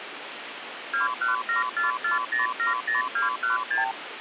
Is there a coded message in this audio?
Yes: multi-frequency trunk signalling (R2, with the far end's replies) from 0.9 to 3.9 s, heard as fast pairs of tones, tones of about 140 ms, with phone line noise. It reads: 21744070216